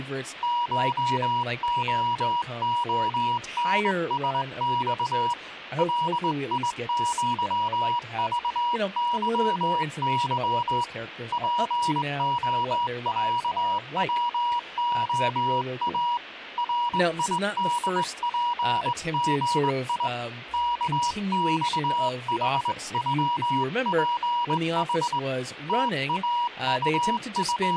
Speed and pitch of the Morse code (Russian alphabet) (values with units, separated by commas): 20 wpm, 960 Hz